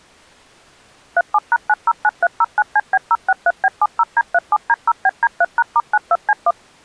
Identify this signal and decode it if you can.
DTMF, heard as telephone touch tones, dialled by machine, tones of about 40 ms. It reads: 37#909309CB063B70D37D0BD3#*92C1